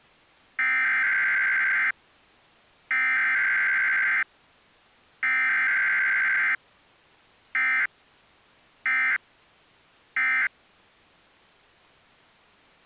Emergency Alert System (SAME) tones (header bursts, then end-of-message bursts), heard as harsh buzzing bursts, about 520.83 baud.